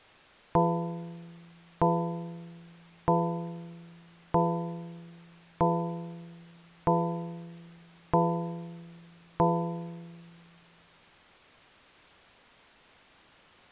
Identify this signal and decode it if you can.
Clock strike, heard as a bell. 8. Eight o'clock.